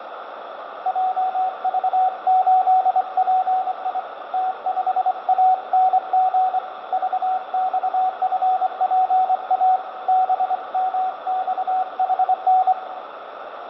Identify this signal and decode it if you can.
Morse code, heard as a keyed tone, hand-sent with a straight key, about 24 wpm, 750 Hz, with radio static and room echo. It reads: JV8PI T5ANG VXFPA BMXHN